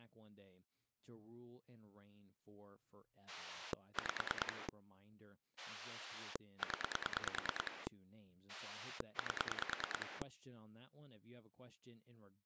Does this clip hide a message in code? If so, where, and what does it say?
Yes: pulse dialling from 3.3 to 10.2 s, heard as a rotary dial, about 9 pulses a second, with speech in English. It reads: 5 0 8